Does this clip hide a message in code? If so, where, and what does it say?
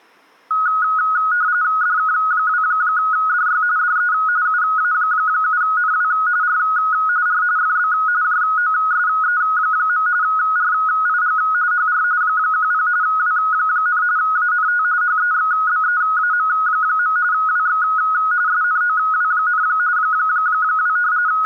Yes: RTTY (45.45 baud, 170 Hz shift) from 0.5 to 21.5 s, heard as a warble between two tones, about 1360 Hz centre. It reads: DK2DY DE UA7NW R R FB JOSE. RIG HR 10 W, ANT HEXBEAM. WX SNOW, 2 …